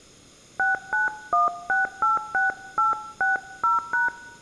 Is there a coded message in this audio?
Yes: DTMF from 0.6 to 4.1 s, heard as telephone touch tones, dialled by hand, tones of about 150 ms. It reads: 691686860#